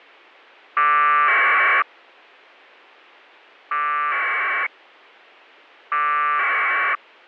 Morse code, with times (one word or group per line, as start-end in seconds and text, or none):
none